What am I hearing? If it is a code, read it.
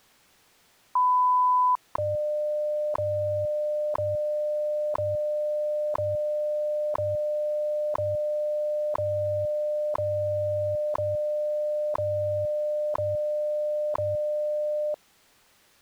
Radio time signal (WWV, Colorado), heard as ticks, one a second.